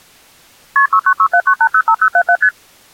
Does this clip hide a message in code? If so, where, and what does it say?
Yes: multi-frequency trunk signalling (R1, as on North American trunks) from 0.8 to 2.5 s, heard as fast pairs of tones, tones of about 70 ms. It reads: KP 69679805077 ST